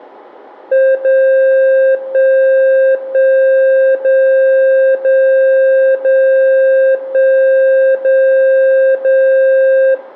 Radio time signal (DCF77), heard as a tone whose level steps once a second, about 530 Hz, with room echo. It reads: 0 1 1 0 0 0 1 0 0